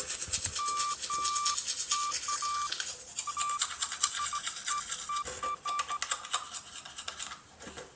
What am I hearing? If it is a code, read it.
Beeps of irregular length, with the noise of a restroom. There is no code.